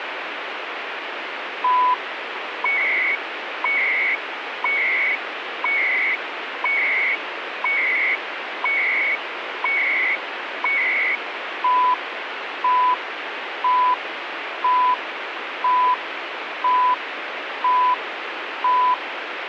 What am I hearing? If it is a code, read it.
Radio time signal (CHU, Canada), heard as beeps and data bursts, one a second, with radio static.